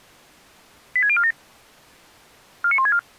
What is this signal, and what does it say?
Five-tone selective call (ZVEI), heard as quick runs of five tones, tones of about 70 ms. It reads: 86047 49164